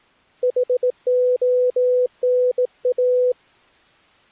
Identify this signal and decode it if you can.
Morse code, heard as a keyed tone, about 18 wpm, 500 Hz. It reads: HONA